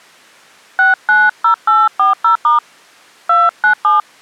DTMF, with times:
0.8-2.6 690840*
3.3-4.0 297

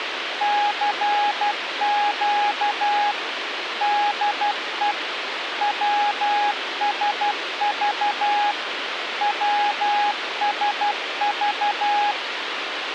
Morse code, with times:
0.4-3.1 CQ
3.8-4.9 DE
5.6-8.5 WSV
9.2-12.1 WSV

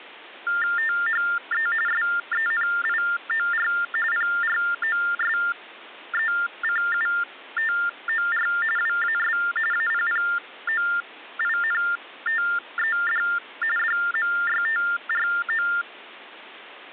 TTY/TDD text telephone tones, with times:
0.8-1.7 THE
1.9-3.7 SENIOR
4.1-8.5 PROSECUTOR
8.8-9.4 WAS
9.7-13.2 APPOINTED
13.8-15.7 DMYTRO

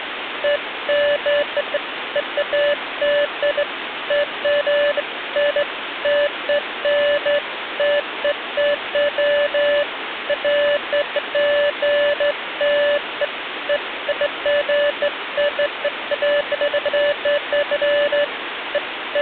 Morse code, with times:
none

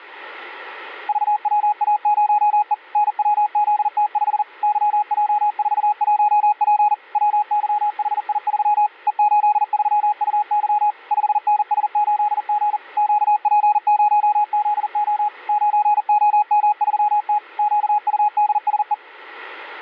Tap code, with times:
none

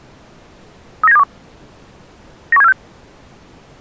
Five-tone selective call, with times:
1.0-1.2 39721
2.5-2.7 91746

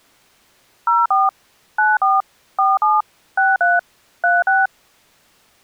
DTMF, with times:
0.9-1.3 04
1.8-2.2 94
2.6-3.0 47
3.4-3.8 63
4.2-4.7 36

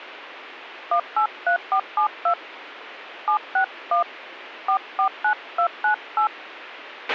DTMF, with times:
0.9-2.3 183472
3.3-4.0 761
4.7-6.3 449298

